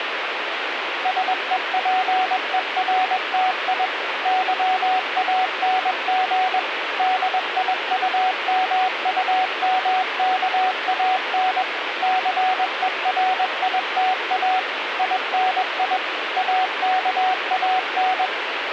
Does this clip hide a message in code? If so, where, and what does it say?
Yes: Morse code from 1.0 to 18.3 s, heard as a keyed tone, machine-sent, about 21 wpm, 750 Hz, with radio static. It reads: SEPERTI YANG DIUMUMKAN CERITA INI AKAN